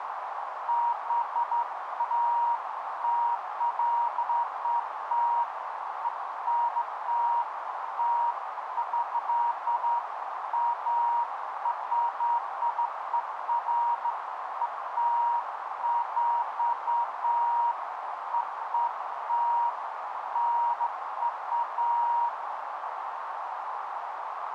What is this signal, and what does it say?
Beeps of irregular length, with radio static and a narrow filter. There is no code.